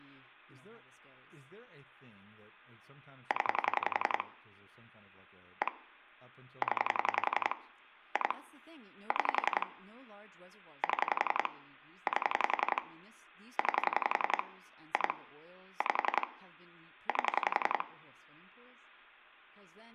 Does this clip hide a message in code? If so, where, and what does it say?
Yes: pulse dialling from 3.3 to 17.8 s, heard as clicks on a phone line, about 11 pulses a second, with room echo and speech in English. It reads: 0 1 0 2 6 7 8 9 2 5 8